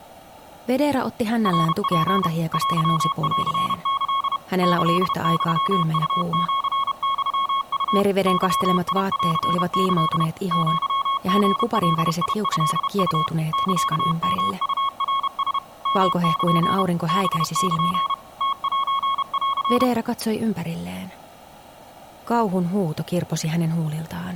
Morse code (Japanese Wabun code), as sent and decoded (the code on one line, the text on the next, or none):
.-. .--. / .-.-- .-.-. -.-.. / -.-.. -..-- ..- --.-. -..-- ..- / -.-- .. .-.-. -.-.. / --.-- --. .-.. .. ..-.. ..- / -.-.- -- ..- .-. ... / -- -.--. / -... -.--. / - .---. .-.-.
ナツ テンキ キユウシユウ ゲンキ アリガトウ サヨウナラ ヨル ハル ムセン